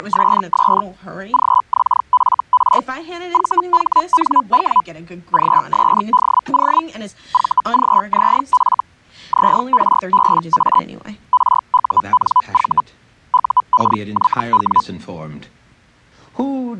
Hellschreiber (Feld-Hell, 122.5 baud), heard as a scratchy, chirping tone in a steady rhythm, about 1000 Hz. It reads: … GXFR VHNW GSDO VGZF ZRBA RUNV UKYW